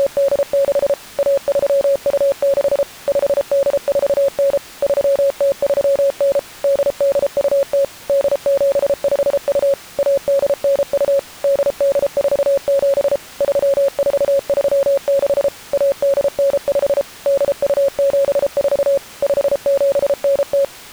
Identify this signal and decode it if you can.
Morse code (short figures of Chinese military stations), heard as a keyed tone, machine-sent, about 33 wpm, 550 Hz. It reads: … 1326 5849 3039 8820 8752 1892 8847 3436 1895 8274 5790